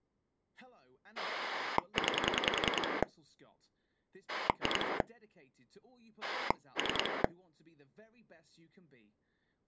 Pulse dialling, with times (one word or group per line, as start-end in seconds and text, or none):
1.2-3.0 9
4.3-5.0 2
6.2-7.2 3